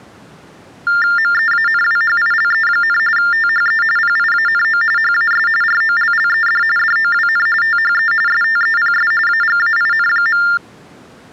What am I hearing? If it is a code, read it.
TTY/TDD text telephone tones (45.45 baud Baudot), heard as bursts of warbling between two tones, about 400 Hz shift, 1600 Hz centre. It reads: MEANWHILE, THE PIANO HAS ROLLED DOWN THE STEPS AGAIN.